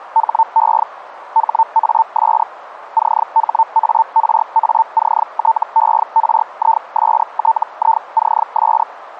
Hellschreiber (Feld-Hell, 122.5 baud), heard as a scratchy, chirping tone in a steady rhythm, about 900 Hz, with radio static. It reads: HE HAS CHARACTERISTICS